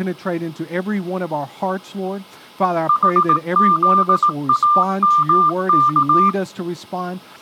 Morse code (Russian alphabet), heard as a keyed tone, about 18 wpm, 1190 Hz. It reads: ХЗАМК